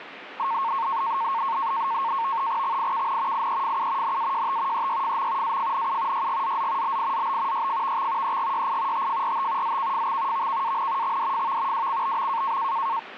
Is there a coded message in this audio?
Yes: NAVTEX (SITOR-B), 100 baud, 170 Hz shift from 0.4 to 13.0 s, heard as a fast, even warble, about 1000 Hz centre, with radio static. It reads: XIKN IEFU NAJT EYFM AFNU YGZZ BIZB YFVX EGYI TFRT ZKFX VKAN XDFV WCBM